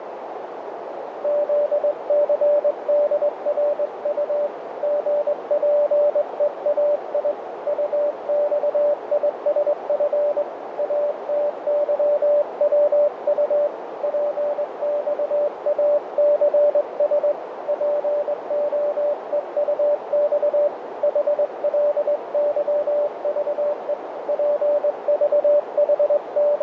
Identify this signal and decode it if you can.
Morse code, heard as a keyed tone, hand-sent with a straight key, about 21 wpm, 590 Hz, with radio static and a narrow filter. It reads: ZCDRU GPEAI UXISF ATYWU PXACS POEUX HLYVE …